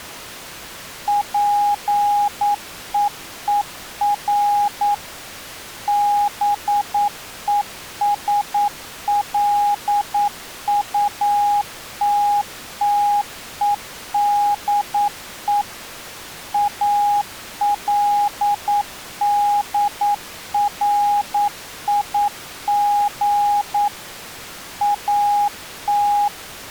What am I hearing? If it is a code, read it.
Morse code, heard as a keyed tone, machine-sent, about 9 wpm, 820 Hz. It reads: PEER BESLUTTEDE ALDRIG AT